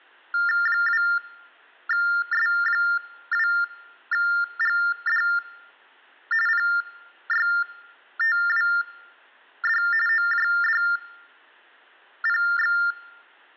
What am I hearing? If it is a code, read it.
TTY/TDD text telephone tones (45.45 baud Baudot), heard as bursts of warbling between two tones, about 400 Hz shift, 1600 Hz centre. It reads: 2S2GD PYTWD OJDPX